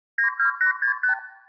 Multi-frequency trunk signalling (R2, with the far end's replies), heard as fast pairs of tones, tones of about 110 ms, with room echo. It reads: 92865